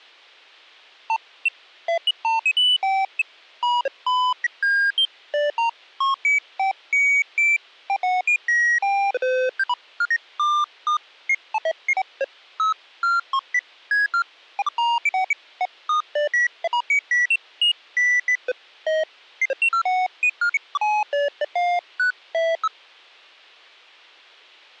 Electronic bleeps of random pitch and length. There is no code.